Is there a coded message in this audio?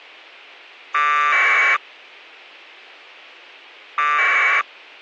Yes: packet radio (AX.25, as in APRS), 1200 baud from 0.9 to 4.6 s, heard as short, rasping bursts, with a squelch burst at the end.